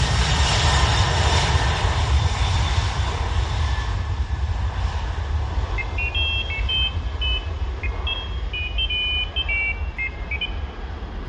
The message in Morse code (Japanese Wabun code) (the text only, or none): none